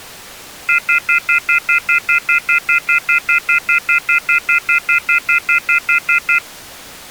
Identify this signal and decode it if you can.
Telephone call progress tone (North American plan), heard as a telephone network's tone, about 1400, 2050, 2450, 2600 Hz, 0.1 s on and 0.1 s off. Off-hook warning tone.